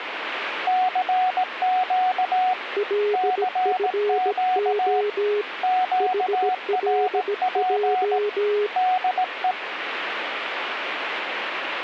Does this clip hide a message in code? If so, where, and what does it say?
Yes: Morse code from 0.6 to 9.6 s, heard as two keyed tones, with radio static. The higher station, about 18 wpm, 740 Hz: CQ CQ QRP DE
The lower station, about 17 wpm, 420 Hz: LFO HLJ